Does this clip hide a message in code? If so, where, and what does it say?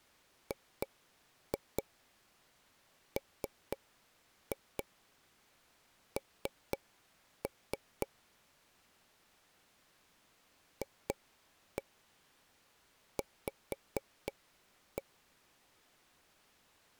Yes: tap code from 0.5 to 15.0 s, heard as taps on a table, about 4 knocks a second. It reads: GMN FV